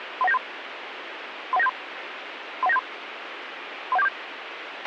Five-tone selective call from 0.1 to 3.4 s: 31973 31973 31973

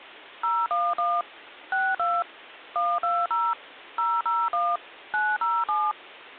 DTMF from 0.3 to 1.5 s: 011

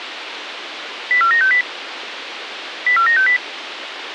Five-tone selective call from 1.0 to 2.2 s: 04960

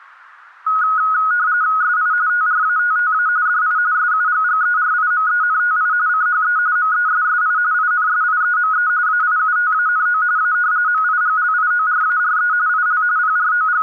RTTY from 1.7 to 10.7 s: SI TRATTA DI SUGGERIMENTI CHE MESSI INSIEME AIUTANO A

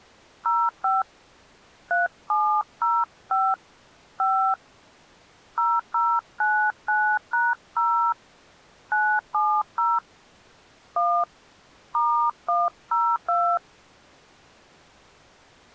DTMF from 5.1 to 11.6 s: 0099#0 970 1

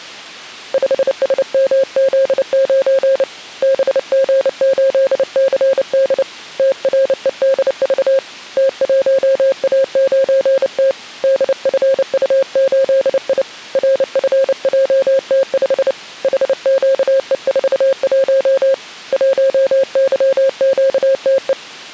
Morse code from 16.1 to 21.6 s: HQE41 1YQTE

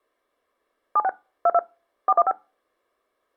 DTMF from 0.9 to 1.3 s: 76

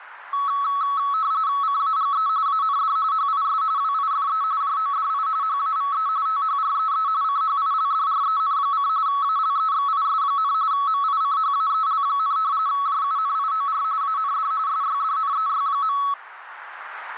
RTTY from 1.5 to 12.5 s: CAGE AND HIS WIFE JODI HAVE THREE CHILDREN: ALEXIS, MICHAEL,

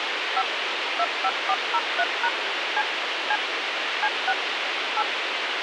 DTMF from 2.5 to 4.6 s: C C C6

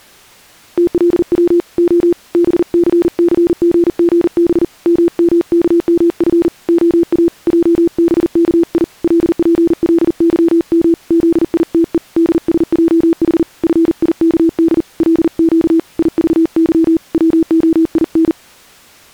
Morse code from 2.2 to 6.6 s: BCCGGB MMKMF

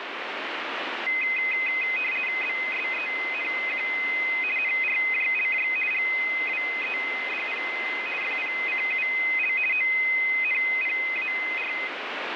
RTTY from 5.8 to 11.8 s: GWEDP FPCUL ONPAR

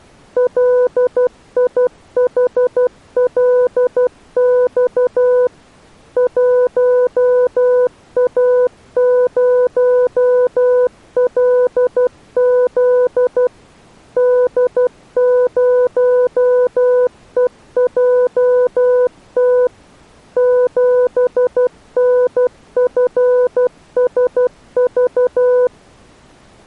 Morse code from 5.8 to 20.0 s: 1A0LZ D0EJT

